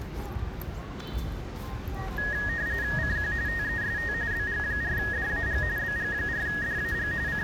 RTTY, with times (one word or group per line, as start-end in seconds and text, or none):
3.0-3.3 CQ
3.5-4.1 TEST
4.3-5.6 BG4DAG
5.8-7.1 BG4DAG
7.3-7.4 …